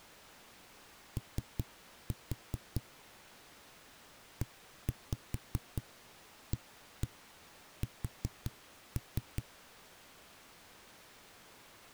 Tap code, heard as knocks on a wall, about 4 knocks a second. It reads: O EAS